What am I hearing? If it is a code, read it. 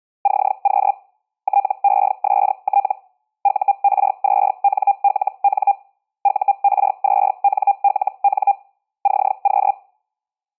Hellschreiber (Feld-Hell, 122.5 baud), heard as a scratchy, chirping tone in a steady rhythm, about 800 Hz. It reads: CQ TEST UR2NLN UR2NLN CQ